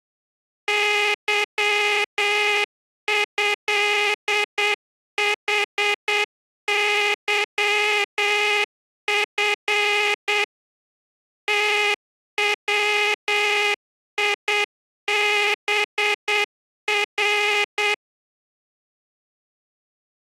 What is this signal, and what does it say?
Morse code (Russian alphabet), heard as a buzzer, machine-sent, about 8 wpm. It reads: ЫЭХЫФ ТВИБР